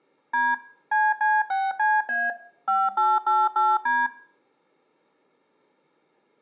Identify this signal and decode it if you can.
DTMF, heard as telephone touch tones, dialled by machine, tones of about 210 ms, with room echo. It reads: D CC6CA 5888D